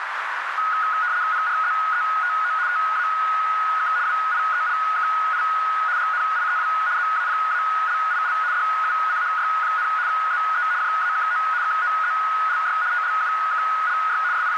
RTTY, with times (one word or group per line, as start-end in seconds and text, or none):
1.3-2.5 PRZETO
2.7-3.9 TAK
4.1-5.4 WIELKI
6.0-6.7 GNIEW
7.0-8.3 ZAPALIL
8.5-9.9 DUCHY,
10.1-10.6 ZE
10.8-11.4 JAKO
11.6-12.8 KOZLY
12.9-14.2 TLUKLY
14.3-14.6 …